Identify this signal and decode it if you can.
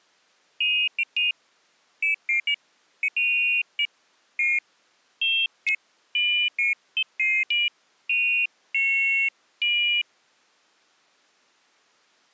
Pairs of high tones at irregular times. There is no code.